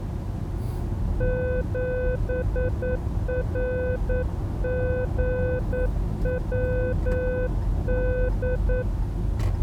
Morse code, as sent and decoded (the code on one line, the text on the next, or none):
--... .-. --. .-- -..
7RGWD